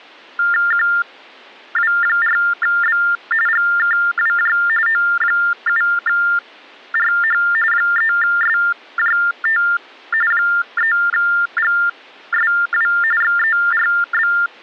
TTY/TDD text telephone tones (45.45 baud Baudot), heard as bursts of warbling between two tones, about 400 Hz shift, 1600 Hz centre. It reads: QW4B GKWJ O7RH 3SJT 3GSW XERB